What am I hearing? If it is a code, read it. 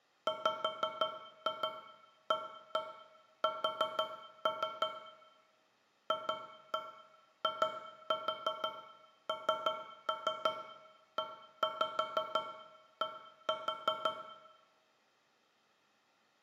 Tap code, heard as taps on a metal pipe, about 5 knocks a second, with room echo. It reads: WAS FINED